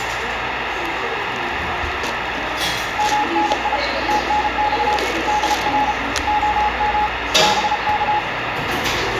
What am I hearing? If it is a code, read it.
Morse code, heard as a keyed tone, hand-sent with a bug key, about 33 wpm, 840 Hz, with radio static and the noise of a cafe. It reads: MNI TNX DR OM BK